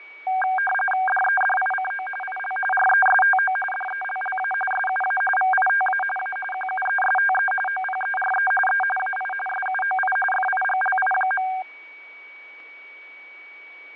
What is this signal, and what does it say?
RTTY (45.45 baud, 850 Hz shift), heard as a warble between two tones, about 1180 Hz centre, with fading and a steady whistle near 2260 Hz. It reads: DEDICO IL RESTO DELLA SUA VITA A QUESTE OPERE E AI SUOI FIGLI.